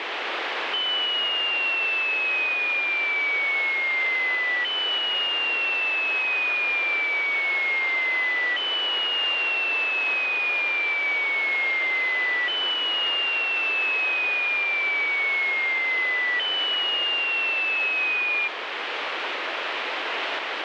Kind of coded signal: none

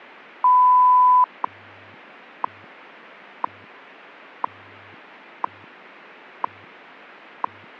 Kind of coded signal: radio time signal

